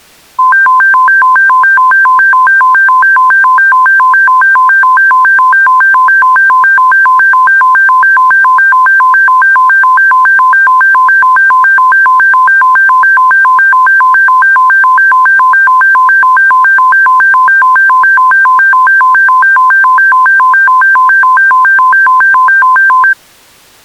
A tone that alternates evenly between two pitches. There is no code.